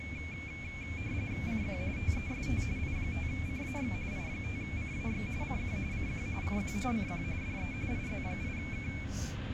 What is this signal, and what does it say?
RTTY (45.45 baud, 170 Hz shift), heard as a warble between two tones, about 2300 Hz centre, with radio static and the noise inside a bus. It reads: CQ TEST I5CAX I5CAX CQ CQ CQ CQ DE IZ8K